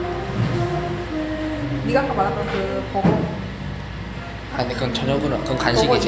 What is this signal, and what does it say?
The noise of a cafe. There is no code.